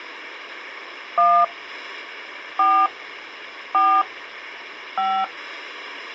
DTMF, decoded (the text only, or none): 1 4 4 5